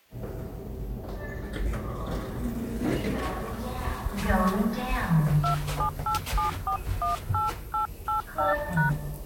DTMF, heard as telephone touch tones, dialled by hand, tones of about 130 ms, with the noise inside a lift. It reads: 2787418885#